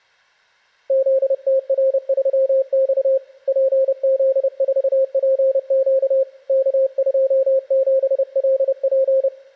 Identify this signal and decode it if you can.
Morse code, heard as a keyed tone, hand-sent with a paddle, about 30 wpm, 530 Hz. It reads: ZTR3X PZ4PQ K27LP